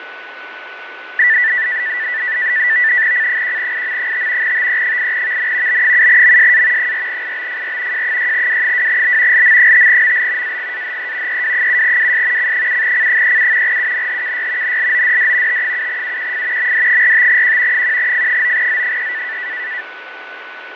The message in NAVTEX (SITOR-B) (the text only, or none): C1IM5 TE8VN B7MSA 4IBFR J6W2B LM5ML AGAHE EW7WS C7C37 UNHKY NLODD T7UQF MD45Q 1F9Z3